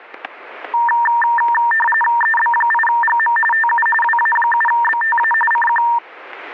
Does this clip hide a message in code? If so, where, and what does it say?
Yes: RTTY (45.45 baud, 850 Hz shift) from 0.7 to 6.0 s, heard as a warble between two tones, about 1370 Hz centre, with static crashes. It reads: EB8GM TU WA7BTA CQ